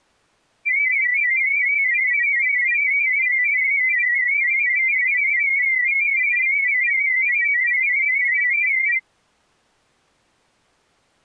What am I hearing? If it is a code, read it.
Multi-tone FSK (Olivia or MFSK type), about 500 Hz wide, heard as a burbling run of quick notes, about 31.25 baud.